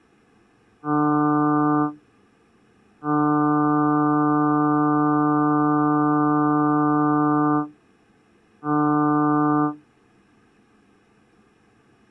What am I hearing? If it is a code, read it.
Ship horn signal, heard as a ship's horn, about 150 Hz. 1 short, 1 long, 1 short. At sea: a vessel at anchor warns of its position.